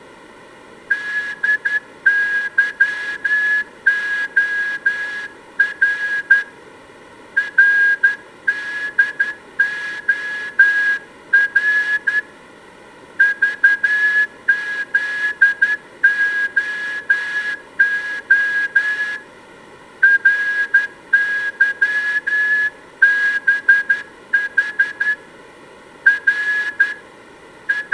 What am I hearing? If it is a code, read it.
Morse code (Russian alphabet), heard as a whistle, hand-sent with a straight key, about 11 wpm, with room echo. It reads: ДЫОР РДОР ЖЗОО РЫБХ Р …